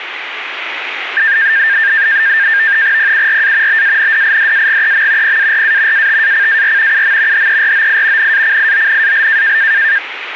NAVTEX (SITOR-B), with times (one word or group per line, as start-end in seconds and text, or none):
3.0-3.8 PURA
3.7-5.4 BANDIDAGEM
5.2-6.1 PARA
5.9-7.0 ATACAR
6.9-7.5 UM
7.3-8.3 HEROI
8.2-9.6 NACIONAL